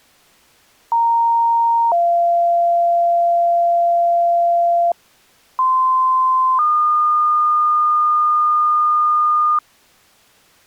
Two-tone page, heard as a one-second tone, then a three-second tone, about 930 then 690 Hz, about 1040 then 1220 Hz.